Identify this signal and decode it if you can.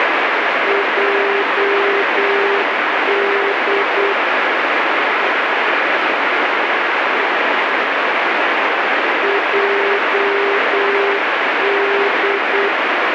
Morse code, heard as a keyed tone, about 8 wpm, 400 Hz, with heavy radio static. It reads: JD JD